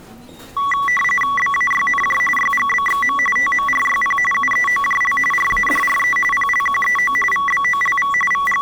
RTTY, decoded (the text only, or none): BAYNJ YGBXM TMRYP UEOJL RADRE PLQEO VBOLV …